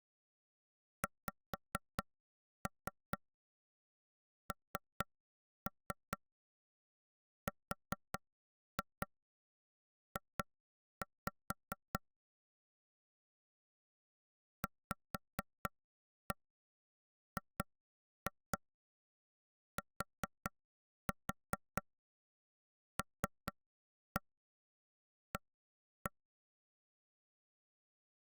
Tap code, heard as taps on a table, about 4 knocks a second. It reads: XNRJ VGTLA